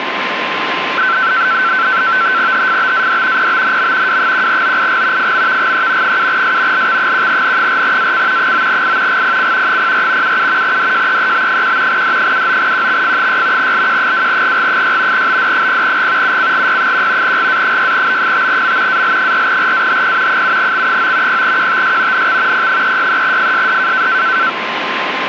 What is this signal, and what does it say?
NAVTEX (SITOR-B), 100 baud, 170 Hz shift, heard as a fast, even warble, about 1440 Hz centre, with radio static and a steady whistle near 1040 Hz. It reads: HFBAD PBNM W1OIG FMVGE 7S LX1N4AC 9I GPC 04 77 DJEEB1 D79QXF6 LQ2GG6 BD0G UCGY1 GA6B5M AL4RAHP 7X9 0QTS NX P363FSD